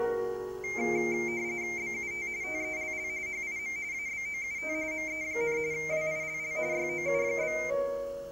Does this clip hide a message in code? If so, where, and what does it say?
Yes: RTTY (45.45 baud, 170 Hz shift) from 0.6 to 7.7 s, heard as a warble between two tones, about 2200 Hz centre, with room echo. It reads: BUT TELL HIM ABOUT ME, WILL YOU?